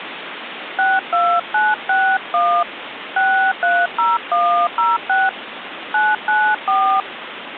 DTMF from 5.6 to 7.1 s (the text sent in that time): 994